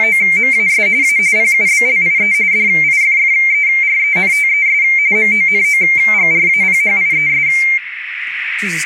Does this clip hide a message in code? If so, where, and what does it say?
Yes: RTTY (45.45 baud, 170 Hz shift) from 0.0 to 7.8 s, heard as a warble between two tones, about 2200 Hz centre, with radio static, a narrow filter and speech in English. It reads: … A PUBLIE DIFFERENTES MONOGRAPHIES